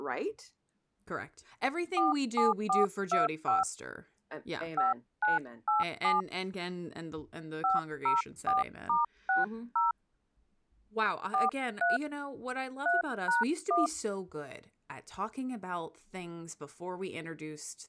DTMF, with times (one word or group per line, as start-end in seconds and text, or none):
2.0-3.6 47425
4.8-6.2 5987
7.6-9.9 504*60
11.3-12.0 43
12.9-13.9 3#1